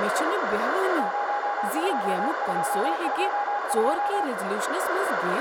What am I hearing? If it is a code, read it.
Morse code, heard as a keyed tone, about 35 wpm, 820 Hz, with radio static, a narrow filter and speech in Kashmiri. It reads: 02222